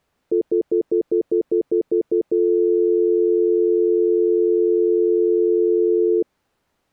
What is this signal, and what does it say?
Telephone call progress tone (North American plan), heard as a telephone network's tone, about 350, 440 Hz, 0.1 s on and 0.1 s off. Stutter dial tone.